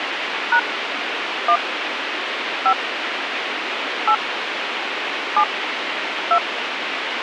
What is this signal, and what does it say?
DTMF, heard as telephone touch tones, dialled by hand, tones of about 70 ms, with radio hiss. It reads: # 1 5 8 7 2